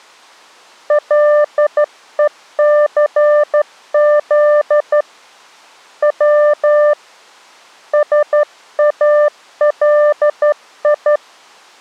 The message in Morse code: LECZ W SALI

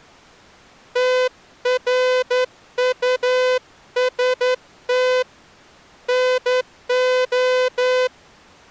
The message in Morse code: TRUST NO

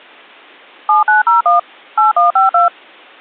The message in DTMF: 7901 8152

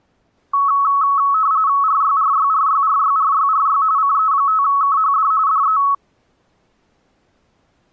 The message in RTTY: RYRYRYRYRYRY CE5KHD DE

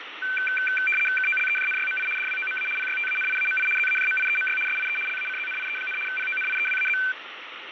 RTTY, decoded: KOLEJNYMI DWOMA PYTANIAMI ZAJMIEMY SIE LACZNIE, PONIEWAZ

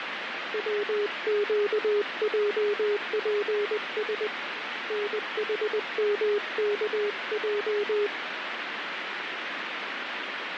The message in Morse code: WQJPS NHMKJ

